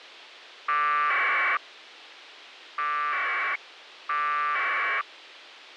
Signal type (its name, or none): packet radio (AX.25, as in APRS)